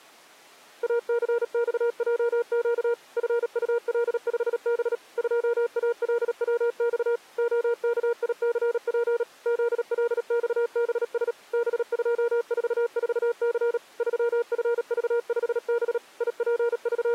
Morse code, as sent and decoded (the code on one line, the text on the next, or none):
.- -.-. -..- .--- --.- / ..-. ..- .-.. ..... -... / ..--- .- .-.. .-- -..- / --- -.- .. -.-. .--. / --.. .-.. -..- -... ... / -... ..--- ....- ....- -.-. / ...-- ..-. ...- ..... -... / …
ACXJQ FUL5B 2ALWX OKICP ZLXBS B244C 3FV5B …